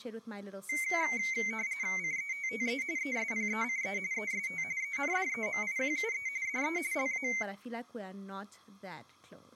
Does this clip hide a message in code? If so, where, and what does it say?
Yes: RTTY (45.45 baud, 170 Hz shift) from 0.7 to 7.4 s, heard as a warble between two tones, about 2150 Hz centre, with room echo and speech in English. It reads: CETTE ESPECE EST ENDEMIQUE DE LA